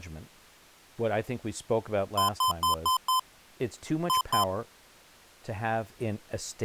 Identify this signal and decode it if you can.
Beep code, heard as beeps from a small speaker, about 1030 Hz, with speech in English. 5-2.